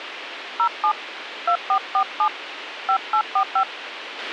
DTMF, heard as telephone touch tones, dialled by hand, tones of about 80 ms, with radio hiss and a squelch burst at the end. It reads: 07 2447 5845